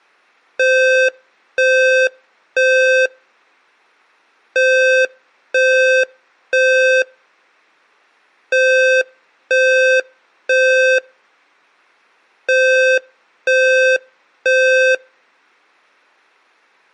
Alarm pattern, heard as an alarm's beeps, played four times, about 520 Hz. Temporal three. Smoke or fire, evacuate.